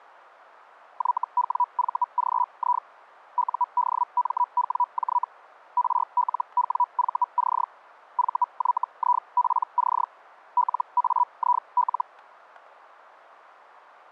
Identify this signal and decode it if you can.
Hellschreiber (Feld-Hell, 122.5 baud), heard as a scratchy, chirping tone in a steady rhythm, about 980 Hz. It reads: YWVGI UDMWJ RLWVC VYIPC LAIL